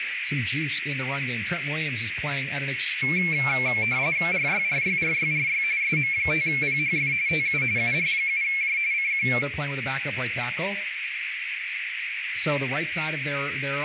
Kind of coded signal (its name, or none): RTTY